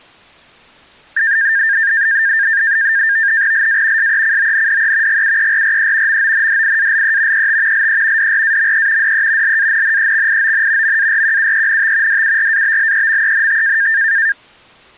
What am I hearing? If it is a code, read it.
NAVTEX (SITOR-B), 100 baud, 170 Hz shift, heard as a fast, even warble, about 1700 Hz centre. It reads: LA SECONDE GUERRE MONDIALE ET LE DRAME DE LANNEXION MARQUENT DURABLEMENT